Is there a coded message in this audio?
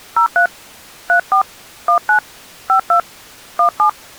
Yes: DTMF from 0.2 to 3.9 s, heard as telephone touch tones, dialled by hand, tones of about 100 ms. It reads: 03 34 19 52 17